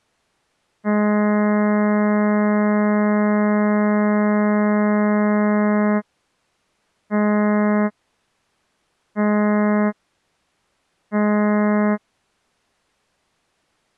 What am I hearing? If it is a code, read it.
Ship horn signal, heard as a ship's horn, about 210 Hz. 1 long, 3 short. At sea: a vessel under tow in fog.